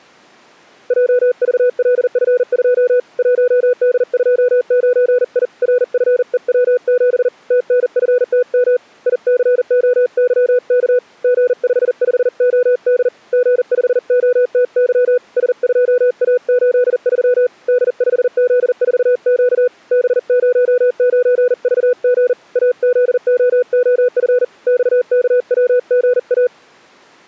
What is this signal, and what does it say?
Morse code, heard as a keyed tone, hand-sent with a paddle, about 40 wpm, 500 Hz. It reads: JVLF2 1D29I RFEW7 TNFTM ICOYK G55OD G5OTY S2A83 D5Z4Q B09VG AZOOF XKWGA